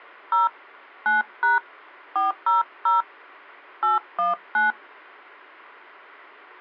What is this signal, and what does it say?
DTMF, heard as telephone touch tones, dialled by hand, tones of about 150 ms. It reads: 0 9# 400 819